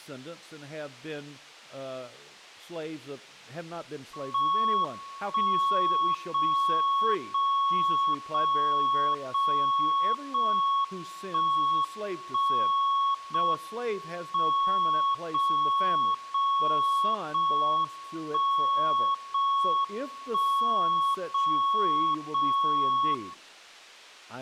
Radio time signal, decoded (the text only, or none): 1 0 0 0 0 0 1 1 0 M 0 0 0 1 0 1 0 0 0